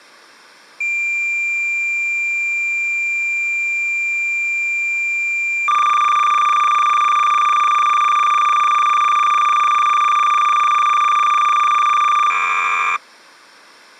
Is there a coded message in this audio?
Yes: cassette data (Kansas City type), 300 baud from 0.8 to 13.0 s, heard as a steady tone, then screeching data.